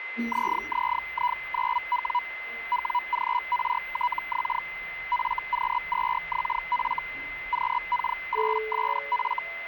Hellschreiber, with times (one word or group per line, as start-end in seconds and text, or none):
0.3-2.2 ZZI9W
2.7-4.6 WGRTX
5.1-7.0 FQ2XF
7.5-9.4 QK8SF